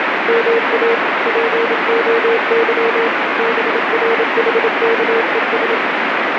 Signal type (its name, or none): Morse code